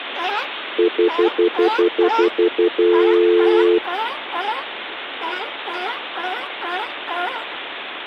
Telephone call progress tone (North American plan), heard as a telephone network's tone, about 350, 440 Hz, 0.1 s on and 0.1 s off, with phone line noise. Stutter dial tone.